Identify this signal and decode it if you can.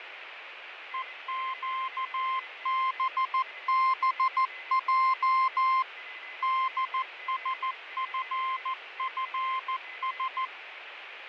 Morse code, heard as a keyed tone, machine-sent, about 14 wpm, 1050 Hz, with radio static, fading and a weaker station near 2030 Hz. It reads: EQBBJ DSFFS